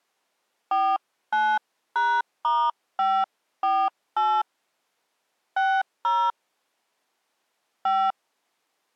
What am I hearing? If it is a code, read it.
DTMF, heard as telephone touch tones, dialled by hand, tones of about 250 ms. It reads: 49#*548 60 5